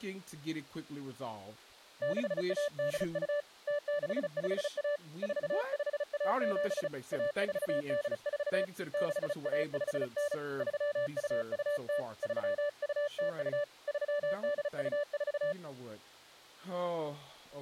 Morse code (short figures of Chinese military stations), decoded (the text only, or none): 6182 0651 4517 1484 6159 3220 3202 3824